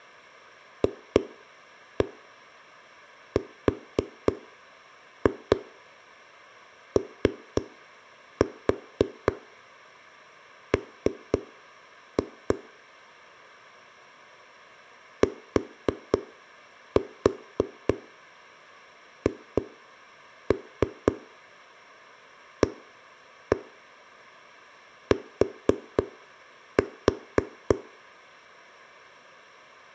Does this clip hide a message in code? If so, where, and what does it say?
Yes: tap code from 0.8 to 27.8 s, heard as knocks on a wall, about 3 knocks a second. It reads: FROM THAT